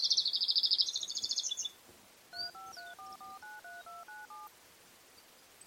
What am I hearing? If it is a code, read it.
DTMF, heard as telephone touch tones, dialled by machine, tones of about 170 ms. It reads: 3534493297